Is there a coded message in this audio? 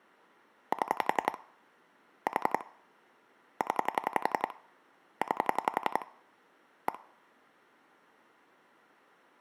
Yes: pulse dialling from 0.7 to 7.0 s, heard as clicks on a phone line, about 11 pulses a second. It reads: 7 4 0 9 1